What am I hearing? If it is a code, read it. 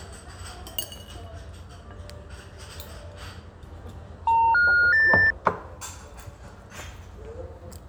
Telephone call progress tone (North American plan), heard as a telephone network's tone, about 910, 1430, 1800 Hz, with the noise of a restaurant. Special information tone.